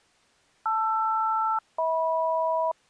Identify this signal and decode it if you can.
Aircraft SELCAL, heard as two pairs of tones. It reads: LR-HM